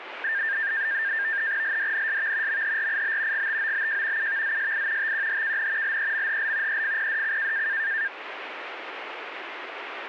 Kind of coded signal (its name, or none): NAVTEX (SITOR-B)